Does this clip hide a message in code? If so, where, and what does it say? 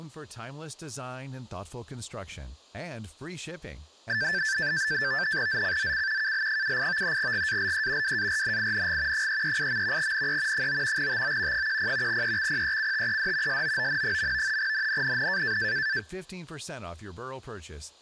Yes: NAVTEX (SITOR-B), 100 baud, 170 Hz shift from 4.1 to 16.0 s, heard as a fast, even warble, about 1650 Hz centre, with speech in English. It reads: ZCZC KL78 GALE WARNING 338. NE 9 TO 10 EXPECTED SOON. NNNN